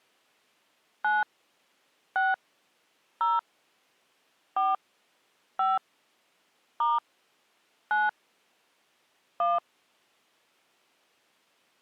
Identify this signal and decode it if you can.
DTMF, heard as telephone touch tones, dialled by hand, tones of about 180 ms. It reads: 9 6 0 4 5 * 9 1